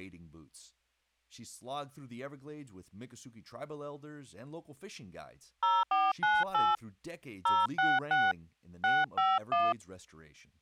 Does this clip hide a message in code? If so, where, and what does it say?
Yes: DTMF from 5.6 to 9.7 s, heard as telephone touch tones, dialled by hand, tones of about 210 ms, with speech in English. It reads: 0498 066 651